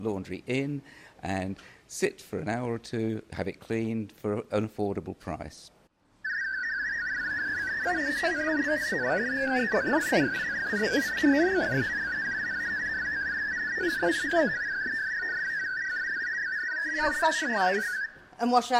Multi-tone FSK (Olivia or MFSK type), about 500 Hz wide, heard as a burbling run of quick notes, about 62.5 baud.